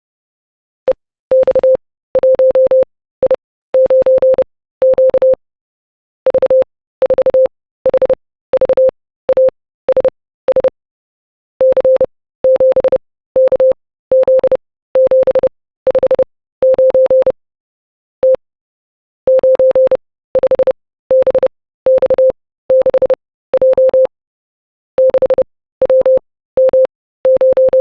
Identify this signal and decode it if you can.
Morse code, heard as a keyed tone, machine-sent, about 30 wpm, spaced as for 16 wpm, 520 Hz. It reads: EX1I9Q V4HVASS C7KZ759 T 95BX6J …